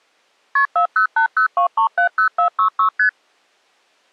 Multi-frequency trunk signalling (R1, as on North American trunks), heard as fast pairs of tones, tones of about 100 ms. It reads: KP 40802370466 ST